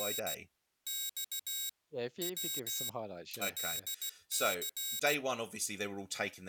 Morse code, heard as a high beeper, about 16 wpm, 3800 Hz, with speech in English. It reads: … X W LC